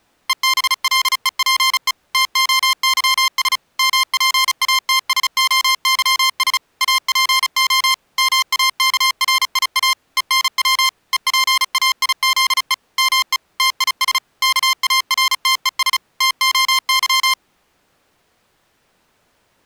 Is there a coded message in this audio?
Yes: Morse code (Greek alphabet) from 0.2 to 17.4 s, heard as electronic beeps, machine-sent, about 35 wpm, 1050 Hz. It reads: ΕΒΛΕΠΕ ΤΟΥΣ ΜΠΑΤΣΟΥΣ ΑΠΟ ΜΑΚΡΙΑ ΕΝΩ ΕΠΑΙΖΕ ΜΕ ΤΙΣ ΚΑΡΤΕΣ ΤΟΥ